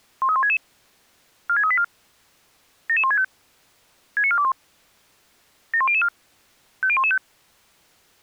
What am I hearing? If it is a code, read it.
Five-tone selective call (ZVEI), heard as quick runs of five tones, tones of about 70 ms. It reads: 13166 46384 77165 69421 71004 50115